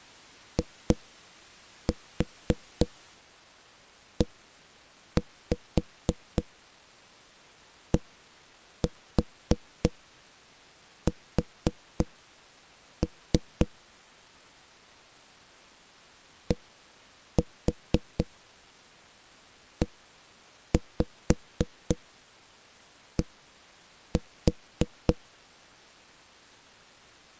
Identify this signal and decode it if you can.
Tap code, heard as knocks on a wall, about 3 knocks a second. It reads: IEDS DED